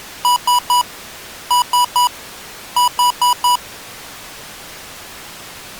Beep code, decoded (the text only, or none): 3-3-4